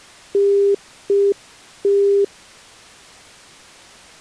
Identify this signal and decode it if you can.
Telephone call progress tone (UK plan), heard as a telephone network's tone, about 400 Hz. Congestion tone.